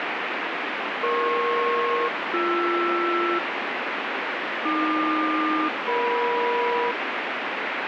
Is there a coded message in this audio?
Yes: aircraft SELCAL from 1.0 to 6.9 s, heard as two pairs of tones, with heavy radio static. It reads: EP-BR AQ-EM